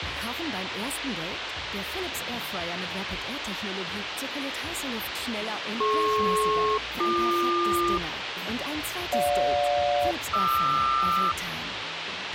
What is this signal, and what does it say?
Aircraft SELCAL, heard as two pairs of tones, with radio hiss and a squelch burst at the end. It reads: DP-BQ GJ-QR